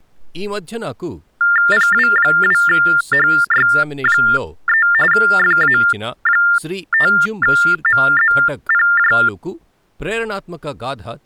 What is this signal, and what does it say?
TTY/TDD text telephone tones (45.45 baud Baudot), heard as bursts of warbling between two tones, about 400 Hz shift, 1600 Hz centre, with speech in Telugu. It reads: PW2HY3 FA5MZPJ